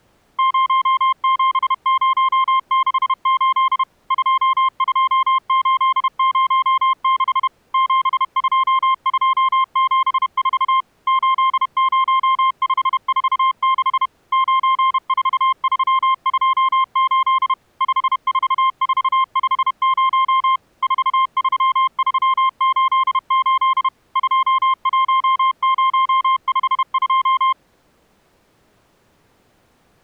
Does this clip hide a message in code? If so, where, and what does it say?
Yes: Morse code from 0.3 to 27.6 s, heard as a keyed tone, machine-sent, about 31 wpm, 1060 Hz. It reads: 07068 22806 72274 80546 94328 54450 43388 21052